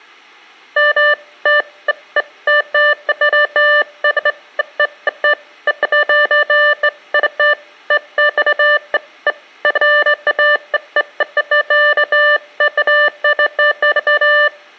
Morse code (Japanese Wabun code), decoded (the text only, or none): none